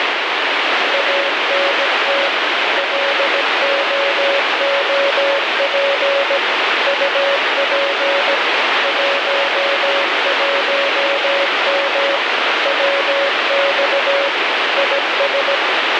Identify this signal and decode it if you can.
Morse code, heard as a keyed tone, machine-sent, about 17 wpm, 560 Hz, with heavy radio static. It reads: ANT LOOP UP 11M WX IS